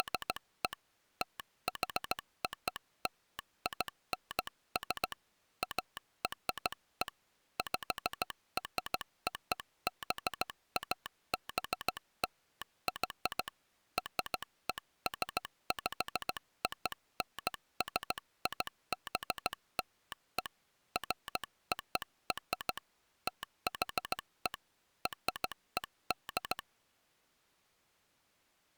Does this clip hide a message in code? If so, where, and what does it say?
Yes: Morse code (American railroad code) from 0.0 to 26.7 s, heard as a telegraph sounder, hand-sent with a straight key. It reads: … THOLINS ARE PROBABLY RESPONSIBLE FOR THE RED